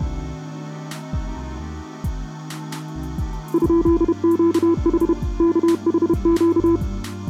Morse code, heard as a keyed tone, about 31 wpm, 340 Hz. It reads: ?QH KHQ